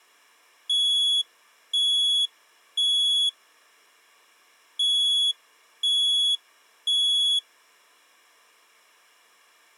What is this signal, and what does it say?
Alarm pattern, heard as an alarm's beeps, played twice, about 3350 Hz. Temporal three. Smoke or fire, evacuate.